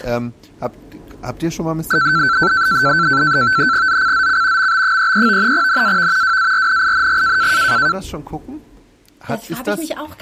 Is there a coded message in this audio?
Yes: NAVTEX (SITOR-B), 100 baud, 170 Hz shift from 1.9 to 7.9 s, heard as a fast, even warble, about 1440 Hz centre. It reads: ZCZC MB33 NAV WARNING